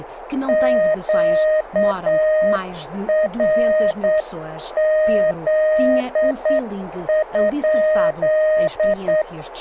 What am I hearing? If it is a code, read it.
Morse code, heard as a keyed tone, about 8 wpm, 620 Hz, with radio static and speech in Portuguese. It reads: QRZ?